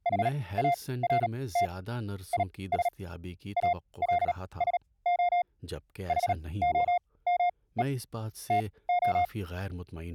Morse code, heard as a keyed tone, machine-sent, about 37 wpm, spaced as for 21 wpm, 700 Hz, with speech in Urdu. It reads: HART IS ALSO HOME TO